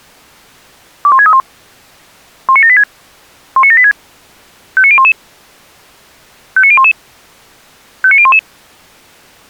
Five-tone selective call (ZVEI), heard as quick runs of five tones, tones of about 70 ms. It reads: 21631 19786 19786 59011 59011 59011